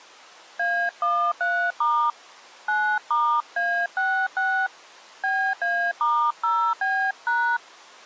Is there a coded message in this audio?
Yes: DTMF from 0.6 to 7.6 s, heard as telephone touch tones, dialled by hand, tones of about 300 ms. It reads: A13* 9*A66 BA*0B#